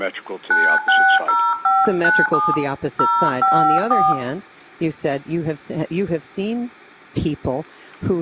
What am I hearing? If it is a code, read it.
DTMF, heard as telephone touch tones, dialled by hand, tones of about 260 ms, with room echo. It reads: 960597 054